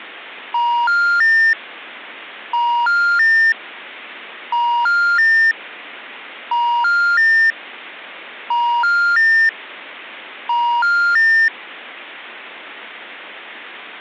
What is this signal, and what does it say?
Telephone call progress tone (ITU plan), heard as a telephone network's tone, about 950, 1400, 1800 Hz. Special information tone.